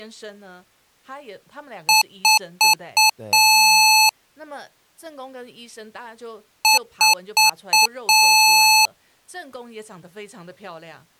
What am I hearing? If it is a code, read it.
Beep code, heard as beeps from a small speaker, played twice, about 870 Hz, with speech in Chinese. 4 short, 1 long.